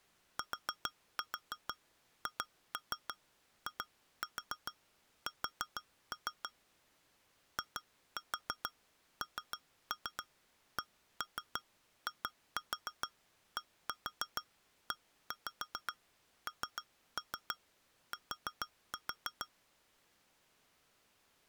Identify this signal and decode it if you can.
Tap code, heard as taps on glass, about 6 knocks a second. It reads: THIS INCIDENT